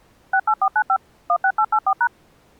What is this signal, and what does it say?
DTMF, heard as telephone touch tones, dialled by machine, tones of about 70 ms. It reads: 68495 16884#